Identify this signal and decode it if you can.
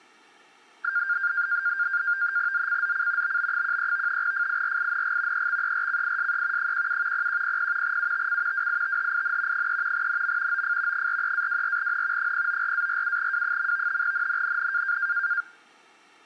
NAVTEX (SITOR-B), 100 baud, 170 Hz shift, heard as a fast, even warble, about 1500 Hz centre. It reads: ZCZC BB13 FIRING EXERCISE 17 0100 UTC WITHIN 3 NM OF 43-24N 094-47W. NNNN